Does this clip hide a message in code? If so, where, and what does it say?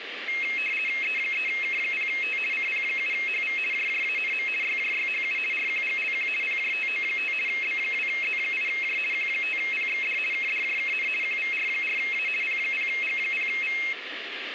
Yes: RTTY (50 baud, 450 Hz shift) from 0.3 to 13.9 s, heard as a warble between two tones, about 2350 Hz centre, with radio static. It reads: E3K0T CP7HV JJANM YJYHU RQGLQ PJTO5 B2Z8J Q5PXD KDJKN QVR4A P0G0V